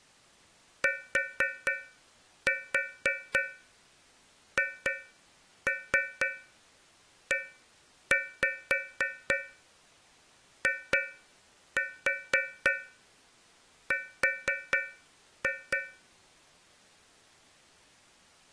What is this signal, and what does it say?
Tap code, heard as taps on a metal pipe, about 4 knocks a second. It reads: THEIR